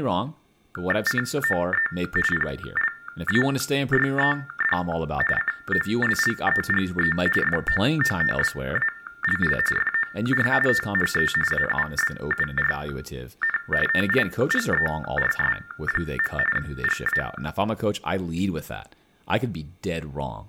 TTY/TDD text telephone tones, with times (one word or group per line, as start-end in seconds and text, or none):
1.1-1.9 COE
2.3-4.8 PLAYED
5.4-7.2 COLLEGE
7.4-9.6 FOOTBALL
9.8-10.5 FOR
10.7-11.3 THE
11.5-13.6 AUBURN
13.9-16.4 TIGERS.
16.6-17.2 GA